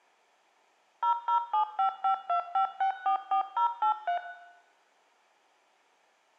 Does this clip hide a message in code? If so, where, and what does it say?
Yes: DTMF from 1.0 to 4.2 s, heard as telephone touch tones, dialled by machine, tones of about 100 ms, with room echo. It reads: 0075525644083